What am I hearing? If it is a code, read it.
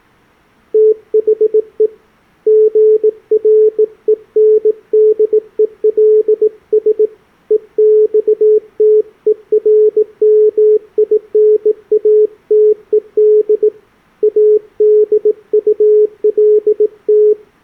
Morse code, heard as a keyed tone, hand-sent with a bug key, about 18 wpm, 430 Hz. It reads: THE GRENDELS EXTERMINATED ADULT